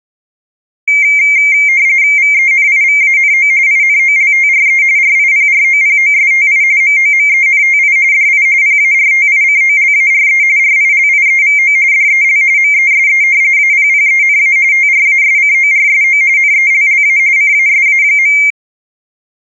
RTTY (45.45 baud, 170 Hz shift), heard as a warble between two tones, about 2200 Hz centre. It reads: VENIVANO INOLTRE RIPROPOSTI MOMENTI DI PARTICOLARE RILIEVO DEL MESE APPENA TRASCORSO NELLA CASA.